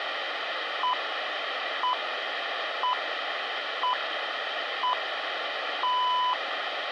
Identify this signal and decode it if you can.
Radio time signal (six pips, as the Greenwich Time Signal), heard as pips.